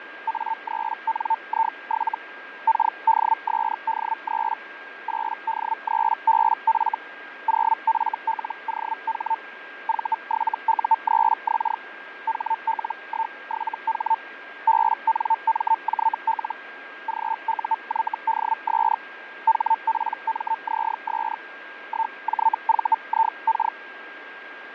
Hellschreiber (Feld-Hell, 122.5 baud), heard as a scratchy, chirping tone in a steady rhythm, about 900 Hz, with radio static, fading and a steady whistle near 1610 Hz. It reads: A3NI7 KDSD3 8D3BF 0FLOH V7U3X HL17H BNMJL GUYDS HPMZS 1JVIK